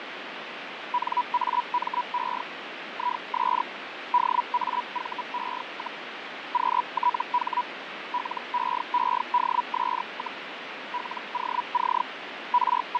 Hellschreiber (Feld-Hell, 122.5 baud), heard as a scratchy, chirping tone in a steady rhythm, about 980 Hz, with radio static and fading. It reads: NAME IS DAVE, QTH LEEDS, LOC …